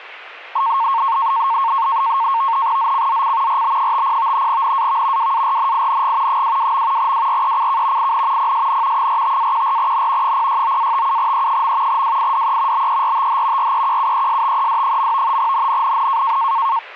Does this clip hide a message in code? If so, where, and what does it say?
Yes: NAVTEX (SITOR-B), 100 baud, 170 Hz shift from 0.6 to 16.8 s, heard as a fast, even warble, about 1000 Hz centre. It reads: ZCZC RB50 NAV WARNING 22. WRECK IN PSN 45-14N 069-57E. WIDE BERTH REQUESTED. NNNN